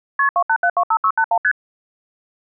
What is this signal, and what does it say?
Multi-frequency trunk signalling (R1, as on North American trunks), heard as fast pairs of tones, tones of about 70 ms. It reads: KP 28725681 ST